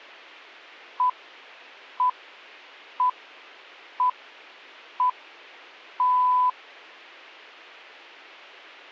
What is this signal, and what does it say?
Radio time signal (six pips, as the Greenwich Time Signal), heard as pips.